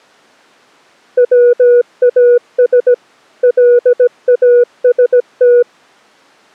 Morse code, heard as a keyed tone, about 17 wpm, 480 Hz. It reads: WAS LAST